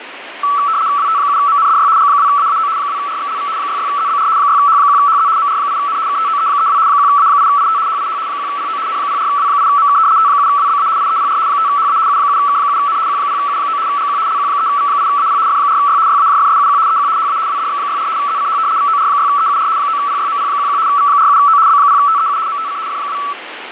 RTTY (75 baud, 170 Hz shift), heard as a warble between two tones, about 1230 Hz centre, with radio static. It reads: WT7MNDY G2AAO 2RXLV 66ZBR 6H1HZ MR8N KTOE32 1A8IT HIH 1PO N04W8MK T7WBA IEPR 5HA U7K7N Q0U9 GQ LQ3V8AP F4Y YAJFSUQ EQ HA WDX64 ZCH VOR6EUR 9PYMP11 V47O B0TEU MTC F2